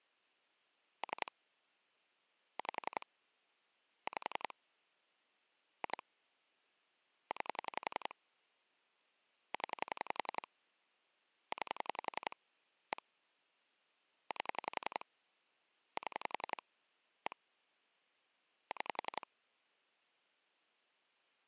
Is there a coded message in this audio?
Yes: pulse dialling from 1.0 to 19.2 s, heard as clicks on a phone line, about 11 pulses a second. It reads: 3 5 5 2 9 0 9 1 8 7 1 6